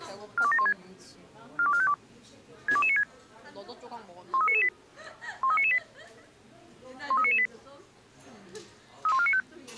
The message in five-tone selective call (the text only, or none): 42716 42452 62296 13998 13998 13998 31495